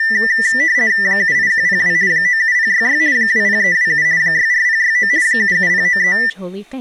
RTTY (50 baud, 170 Hz shift), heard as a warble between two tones, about 1900 Hz centre, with speech in English. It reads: 78102 97066 20327 64069 77093